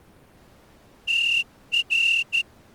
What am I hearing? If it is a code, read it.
Morse code, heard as a whistle, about 14 wpm. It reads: TR